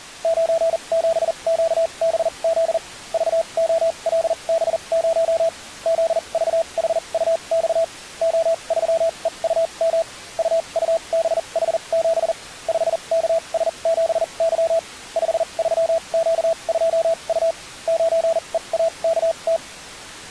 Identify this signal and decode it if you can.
Morse code, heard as a keyed tone, machine-sent, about 40 wpm, spaced as for 31 wpm, 660 Hz. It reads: 97QBZ VOLB0 ZVHUX O3EUM UUBH7 5KS7Y 53Q2U 9EAKT